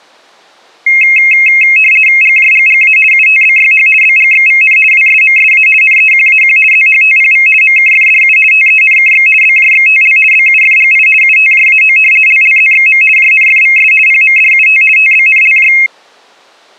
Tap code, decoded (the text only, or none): none